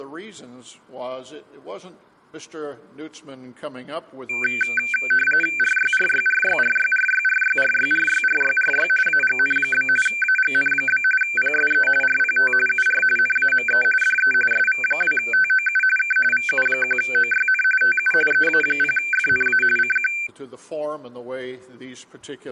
RTTY (45.45 baud, 850 Hz shift), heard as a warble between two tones, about 1950 Hz centre. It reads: RYRYRYRYRYRYRYRYRYRY AGN? AGN? PSE RPT UR NAME DE SV2TOU K VU1OYN TU EA0FNA CQ